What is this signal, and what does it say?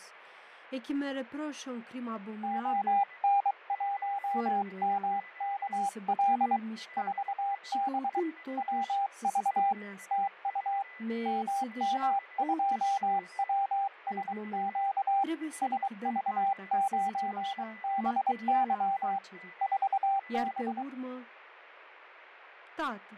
Morse code, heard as a keyed tone, hand-sent with a paddle, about 23 wpm, 790 Hz, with fading, a weaker station near 2000 Hz and speech in Romanian. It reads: ON1MKL 4B WV TU MM2WSQ SV9BY 4B